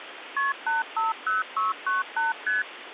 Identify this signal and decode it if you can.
Multi-frequency trunk signalling (R1, as on North American trunks), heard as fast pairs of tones, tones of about 160 ms, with phone line noise. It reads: KP 850698 ST